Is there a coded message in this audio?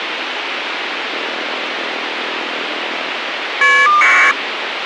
Yes: caller ID data burst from 1.1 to 4.3 s, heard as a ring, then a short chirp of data, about 1200 baud, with phone line noise.